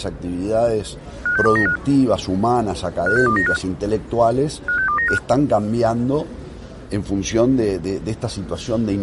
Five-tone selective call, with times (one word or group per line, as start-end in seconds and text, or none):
1.3-1.8 56295
3.1-3.6 56295
4.7-5.2 56295